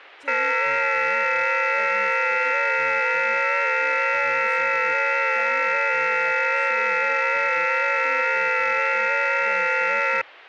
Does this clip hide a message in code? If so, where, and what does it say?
Yes: FT8 (several signals at once) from 0.3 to 10.2 s, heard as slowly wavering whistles, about 6.25 baud, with speech in Manipuri.